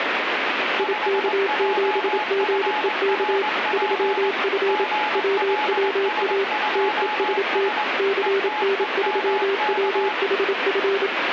Morse code, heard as two keyed tones, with radio static. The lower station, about 27 wpm, 390 Hz: IK7GEK 3F WWA TEST CN3WHF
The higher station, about 21 wpm, 850 Hz: 5JFRP GLS2S ETEMK